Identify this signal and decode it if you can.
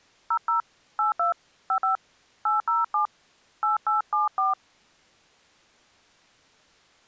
DTMF, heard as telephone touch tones, dialled by hand, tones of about 120 ms. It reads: 00 82 55 807 8874